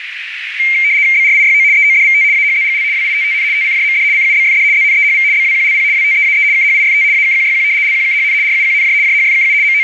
RTTY (75 baud, 170 Hz shift), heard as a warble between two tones, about 2200 Hz centre, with radio static and a narrow filter. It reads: BRIYO EODVT AHZGL WITTN TCJMD CUBFD ZNEHV BWQLP WTEAE KHIFT AKQYQ LQKHN RUQNJ JHFKU …